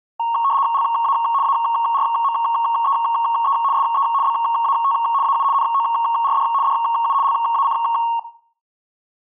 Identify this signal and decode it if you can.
RTTY (75 baud, 170 Hz shift), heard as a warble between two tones, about 1010 Hz centre, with room echo. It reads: LA ARMEE SE BAT AU NORD DU LAC